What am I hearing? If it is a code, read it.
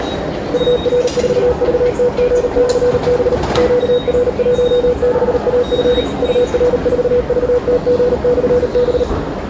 Morse code, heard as a keyed tone, machine-sent, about 38 wpm, 490 Hz, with radio static and the noise of a subway station. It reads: UR4VTG/B QR16AF UR4VTG/B